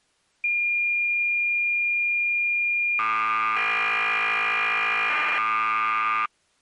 Cassette data (Kansas City type), 1200 baud, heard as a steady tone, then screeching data.